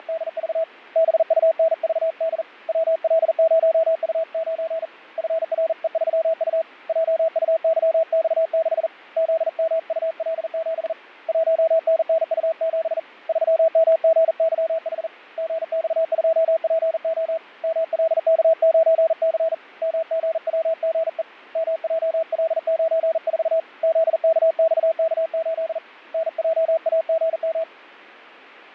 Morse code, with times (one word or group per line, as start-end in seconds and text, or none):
0.0-0.6 …
1.0-2.4 BUNVD
2.7-4.9 WL0U9
5.2-6.6 FRE3U
6.9-8.9 JUYX6
9.2-10.9 ZMUL7
11.3-13.0 1NNU7
13.3-15.1 3MGYH
15.4-17.4 GX2PO
17.6-19.5 MLK9C
19.8-21.2 MGWGE
21.6-23.6 MJL94
23.8-25.8 ZKXK8
26.1-27.6 NJAGM